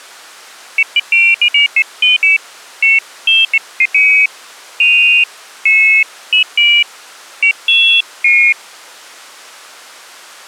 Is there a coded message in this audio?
No, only pairs of high tones at irregular times.